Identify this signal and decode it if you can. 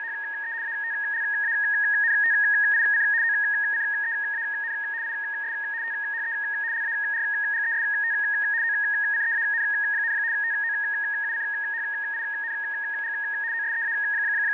RTTY (75 baud, 170 Hz shift), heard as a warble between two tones, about 1750 Hz centre, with fading and a steady whistle near 910 Hz. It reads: … ATLANTIC OCEAN IS THE LARGEST OCEAN, TOUCHING …